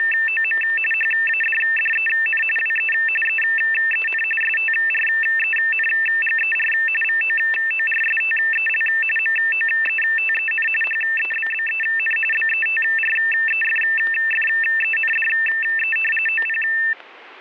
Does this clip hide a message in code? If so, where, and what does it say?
Yes: RTTY (45.45 baud, 850 Hz shift) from 0.0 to 16.9 s, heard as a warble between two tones, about 2250 Hz centre, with static crashes. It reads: … HADDEN WE EEN STRENGER VOORSTEL MOETEN HEBBEN BETREFFENDE OP